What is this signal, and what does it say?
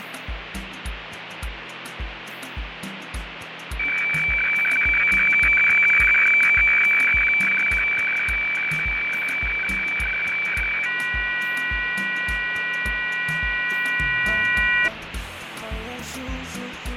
Weather fax (radiofax), 120 lines a minute, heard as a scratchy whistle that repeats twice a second, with radio static and fading.